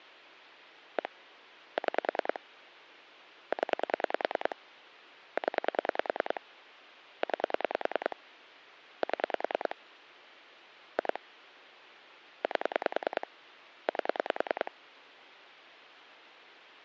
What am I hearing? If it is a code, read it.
Pulse dialling, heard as clicks on a phone line, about 10 pulses a second. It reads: 1 6 0 0 9 7 2 8 8